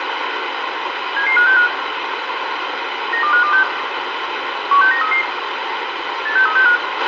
Five-tone selective call (CCIR), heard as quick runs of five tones, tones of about 100 ms, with radio hiss, a squelch burst at the end and room echo. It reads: 77565 92526 16933 86365